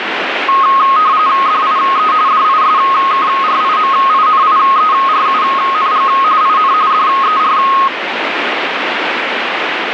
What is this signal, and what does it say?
RTTY (45.45 baud, 170 Hz shift), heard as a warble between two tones, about 1170 Hz centre, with radio static. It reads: DIE DISKRIMINIERUNG IN DER